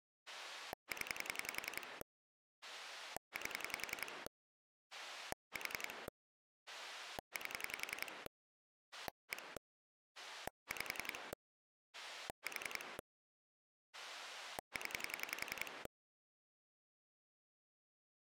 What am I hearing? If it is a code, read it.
Pulse dialling, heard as a rotary dial, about 10 pulses a second. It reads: 0 8 4 8 1 5 4 0